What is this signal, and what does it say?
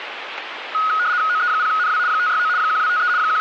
RTTY (75 baud, 170 Hz shift), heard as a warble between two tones, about 1360 Hz centre, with radio static. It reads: OE0NW 569 1253 …